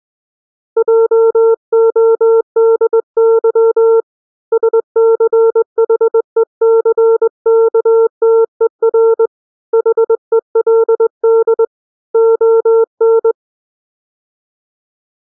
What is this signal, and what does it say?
Morse code, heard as a keyed tone, hand-sent with a straight key, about 21 wpm, 450 Hz. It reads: JODY SCHECKTER HELD ON